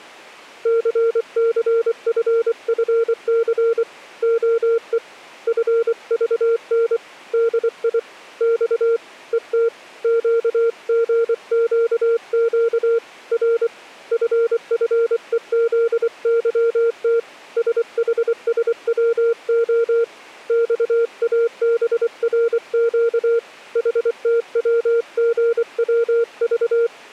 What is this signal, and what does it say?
Morse code, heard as a keyed tone, hand-sent with a paddle, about 24 wpm, 460 Hz. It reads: CCFFC OE FVN DI X ET QGQQ R FFEZYT SHSWO XABRQ HTWGWV